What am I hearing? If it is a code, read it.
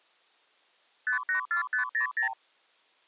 Multi-frequency trunk signalling (R2, with the far end's replies), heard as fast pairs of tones, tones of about 110 ms. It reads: 584500